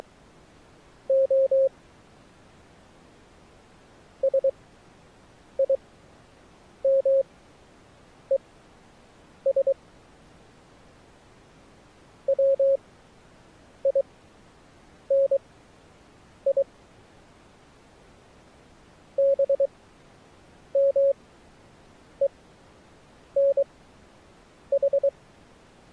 Morse code (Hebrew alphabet), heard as a keyed tone, machine-sent, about 23 wpm, spaced as for 7 wpm, 540 Hz. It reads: … שימוש ציני במונח